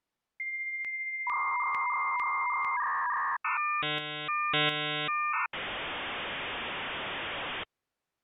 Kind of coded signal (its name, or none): dial-up modem handshake